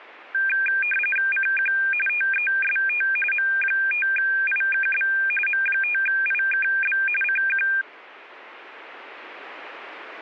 RTTY (45.45 baud, 850 Hz shift), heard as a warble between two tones, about 2000 Hz centre. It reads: CQ TEST M5IKB M5IKB CQ